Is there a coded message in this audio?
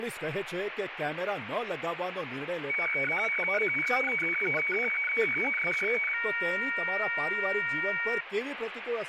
Yes: weather fax (radiofax), 120 lines a minute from 2.7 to 8.2 s, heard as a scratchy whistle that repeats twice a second, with radio static and speech in Gujarati.